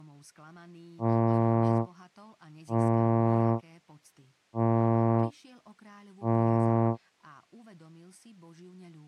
Ship horn signal, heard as a ship's horn, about 110 Hz, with speech in Slovak. 4 short. At sea: a pilot vessel's identity signal in fog.